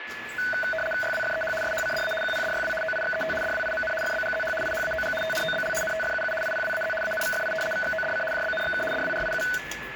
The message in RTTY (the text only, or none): YWFEH SHCDA QPDYW OIXET DWIMN FBGZH IHAOG TNOBL NTFUU IPWAZ ANVFI VXODC JBNXK DWRIU